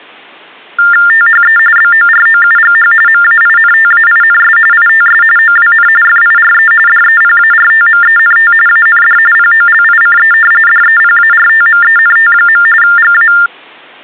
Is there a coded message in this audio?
Yes: TTY/TDD text telephone tones (45.45 baud Baudot) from 0.8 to 13.5 s, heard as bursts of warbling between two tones, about 400 Hz shift, 1600 Hz centre. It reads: THE BOROUGH MAINTAINS ITS OWN FIRE DEPARTMENT AND POLICE DEPARTMENT. GA